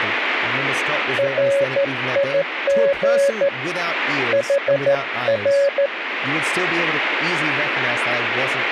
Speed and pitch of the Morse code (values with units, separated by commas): 13 wpm, 560 Hz